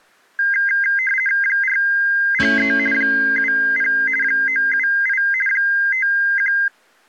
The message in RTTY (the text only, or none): 403 70 978 51